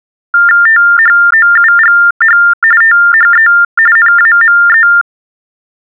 TTY/TDD text telephone tones (45.45 baud Baudot), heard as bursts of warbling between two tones, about 400 Hz shift, 1600 Hz centre. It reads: THOUGH THE NAME